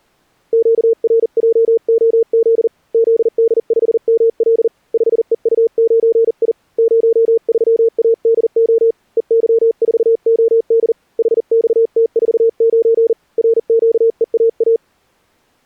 Morse code, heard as a keyed tone, hand-sent with a paddle, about 40 wpm, 460 Hz. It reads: QRJOZ ZD5ML 5EU9I 03ADO EY4OD HXT49 RQEAA